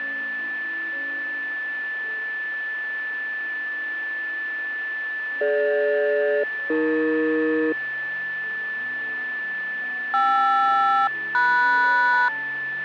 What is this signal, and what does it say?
Aircraft SELCAL, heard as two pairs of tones, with a steady whistle near 1750 Hz. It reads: DG-AE KR-MS